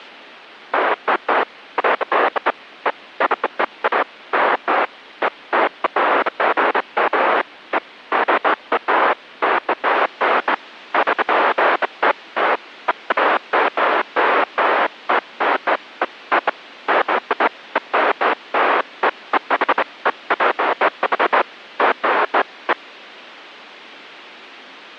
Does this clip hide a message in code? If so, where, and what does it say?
No, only bursts of noise.